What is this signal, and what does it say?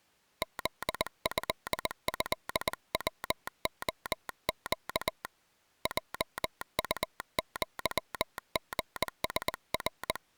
Morse code (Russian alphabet), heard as a telegraph sounder, hand-sent with a paddle, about 20 wpm. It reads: ЗЭЭВОЩ ЙУЪГСР